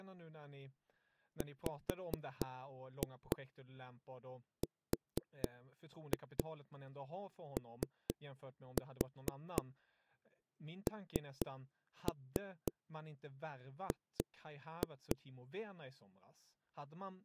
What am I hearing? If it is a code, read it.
Tap code, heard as knocks on a wall, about 4 knocks a second, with speech in Swedish. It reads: WRONG